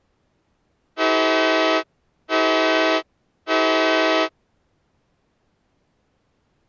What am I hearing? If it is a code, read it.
Train horn signal, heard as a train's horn. 3 short. On North American railways: when stopped, the train will back up.